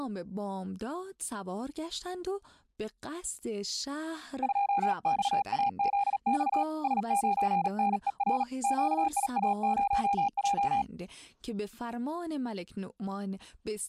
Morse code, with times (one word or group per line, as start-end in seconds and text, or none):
4.4-6.6 2XAZX
6.8-8.4 S9NER
8.6-10.8 QIA0J